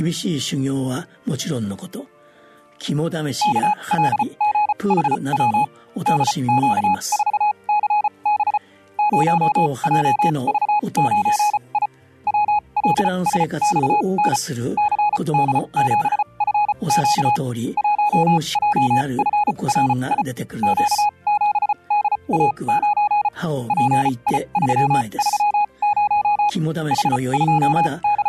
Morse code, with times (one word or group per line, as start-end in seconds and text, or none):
3.4-5.6 KLGHW
6.1-8.6 DQ4CB
9.0-11.9 0JV9I
12.3-14.4 WLSXN
14.8-17.4 CD7FQ
17.8-20.2 1JFRI
20.6-23.3 Q7DA9
23.7-26.5 PI330
26.9-28.3 …